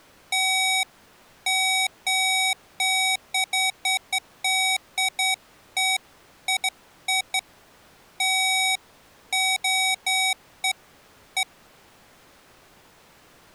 Beeps of irregular length. There is no code.